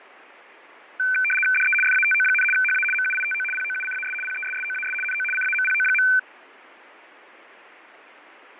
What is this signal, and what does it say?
RTTY (75 baud, 850 Hz shift), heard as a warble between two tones, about 1950 Hz centre, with radio static and fading. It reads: DE FATO, HA MUITO POUCAS PESSOAS NO CAMPO.